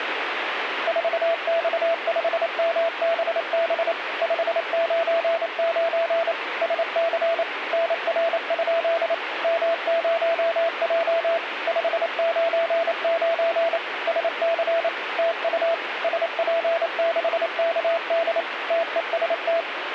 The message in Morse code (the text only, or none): 4X5MBB 599 SC NR? M0J 599 SC TU SP6KD TEST